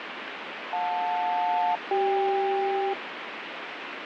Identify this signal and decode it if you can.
Aircraft SELCAL, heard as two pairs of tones, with radio static. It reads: JL-CK